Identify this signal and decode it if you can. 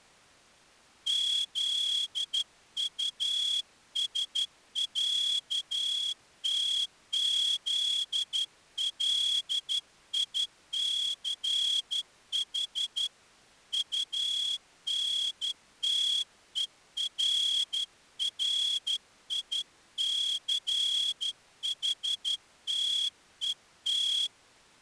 Morse code (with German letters), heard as a whistle, hand-sent with a straight key, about 12 wpm. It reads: ZUSÄTZLICH UNTERRICHTET